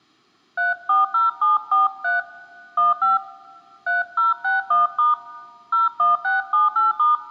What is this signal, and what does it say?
DTMF, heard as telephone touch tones, dialled by hand, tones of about 160 ms, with room echo. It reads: 340743 15 3061* 01678*